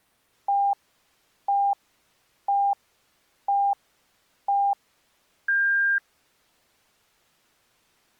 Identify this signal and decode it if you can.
Radio time signal (five pips and a higher one, as on Chinese radio), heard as pips.